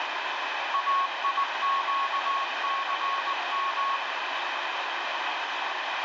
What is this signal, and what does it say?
Morse code, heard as a keyed tone, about 19 wpm, 1100 Hz, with heavy radio static. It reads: AIQCM